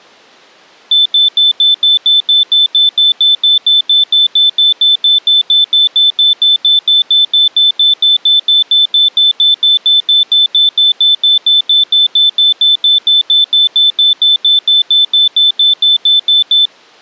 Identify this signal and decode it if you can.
Evenly repeated beeps. There is no code.